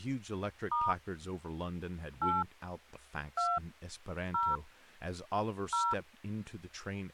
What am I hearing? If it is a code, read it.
DTMF, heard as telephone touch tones, dialled by hand, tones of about 210 ms, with speech in English. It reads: * 8 2 0 0